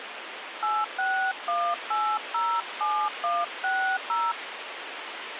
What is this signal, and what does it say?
DTMF, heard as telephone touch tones, dialled by hand, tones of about 270 ms, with phone line noise. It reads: 861807160